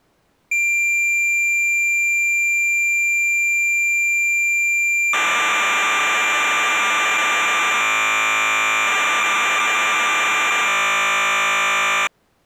Cassette data (Kansas City type), 1200 baud, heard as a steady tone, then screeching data.